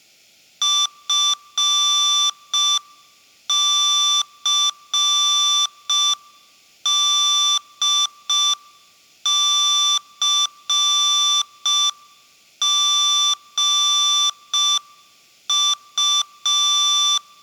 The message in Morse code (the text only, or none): FCDCGU